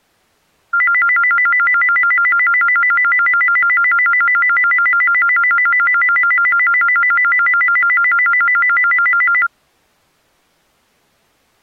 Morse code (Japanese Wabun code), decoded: none

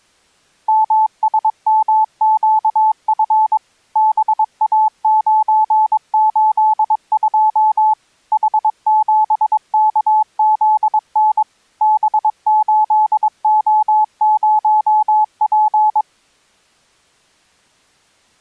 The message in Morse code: MSMQF BA982 H7KZN B8O0P

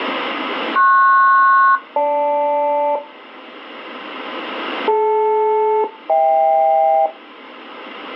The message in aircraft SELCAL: PS-GL DL-HK

